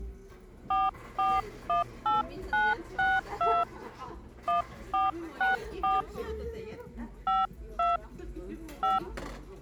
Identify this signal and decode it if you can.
DTMF, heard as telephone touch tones, dialled by hand, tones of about 180 ms, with the noise of a restaurant. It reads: 4418962 1464 52 5